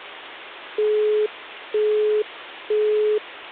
Telephone call progress tone (single-tone plan, as in Europe, Japan and elsewhere), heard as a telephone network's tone, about 420 Hz, 0.48 s on and 0.48 s off. Busy tone.